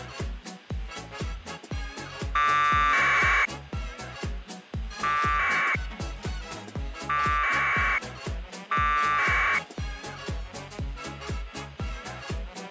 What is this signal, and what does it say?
Packet radio (AX.25, as in APRS), 1200 baud, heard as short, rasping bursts.